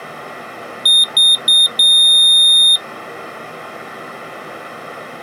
Beep code, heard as a piezo beeper, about 3650 Hz. 3 short, 1 long.